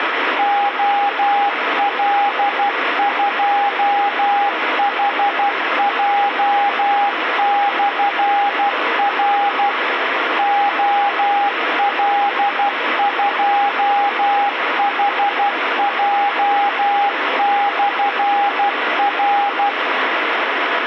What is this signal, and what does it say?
Morse code, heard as a keyed tone, machine-sent, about 12 wpm, 810 Hz, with radio static. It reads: OL2HJ/R OL2HJ/R